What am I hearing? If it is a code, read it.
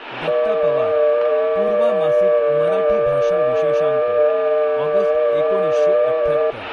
FT8 (several signals at once), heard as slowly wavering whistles, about 6.25 baud, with room echo and speech in Marathi.